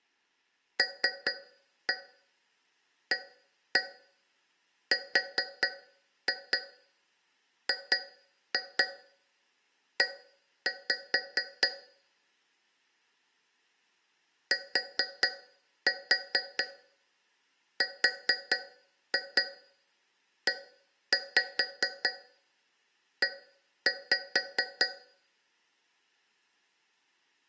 Tap code, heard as taps on a metal pipe, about 4 knocks a second. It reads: LARGE TREE